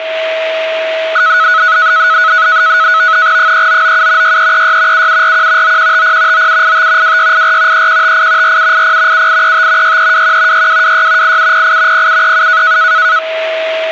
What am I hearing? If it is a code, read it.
NAVTEX (SITOR-B), 100 baud, 170 Hz shift, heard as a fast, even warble, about 1380 Hz centre, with a steady whistle near 640 Hz. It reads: 3997 6336 7741 9150 9785 2684 3158 4780 7835 6321 6226 8708 0737